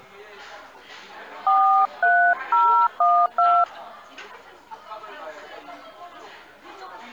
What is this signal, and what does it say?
DTMF, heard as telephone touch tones, dialled by hand, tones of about 290 ms, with the noise of a crowd indoors. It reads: 43012